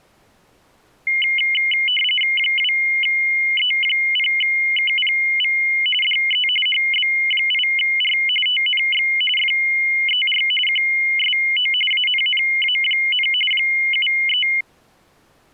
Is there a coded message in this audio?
Yes: RTTY (45.45 baud, 850 Hz shift) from 1.1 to 14.6 s, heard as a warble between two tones, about 2550 Hz centre. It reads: 2E0KPV DE HB8R TNX FER QSO ANNA, 73